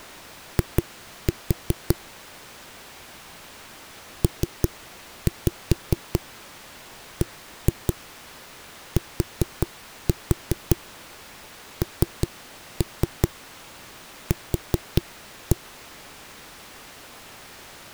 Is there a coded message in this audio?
Yes: tap code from 0.6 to 15.6 s, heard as knocks on a wall, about 5 knocks a second. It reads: I PBTNQ